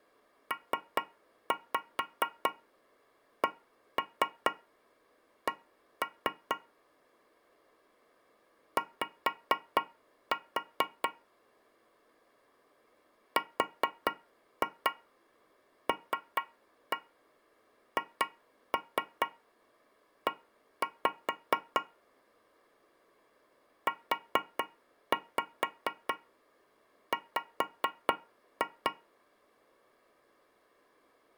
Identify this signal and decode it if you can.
Tap code, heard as taps on a metal pipe, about 4 knocks a second. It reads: PCC Y RLHE UW